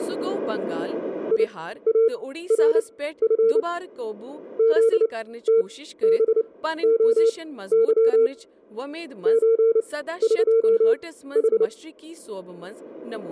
Morse code (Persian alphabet), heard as a keyed tone, machine-sent, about 29 wpm, spaced as for 15 wpm, 460 Hz, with speech in Kashmiri. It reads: یارف زتبعظ چقح